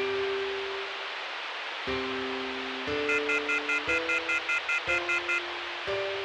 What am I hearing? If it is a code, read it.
Telephone call progress tone (North American plan), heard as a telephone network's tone, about 1400, 2050, 2450, 2600 Hz, 0.1 s on and 0.1 s off, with phone line noise. Off-hook warning tone.